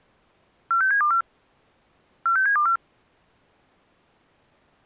Five-tone selective call (CCIR), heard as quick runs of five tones, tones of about 100 ms. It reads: 46724 46724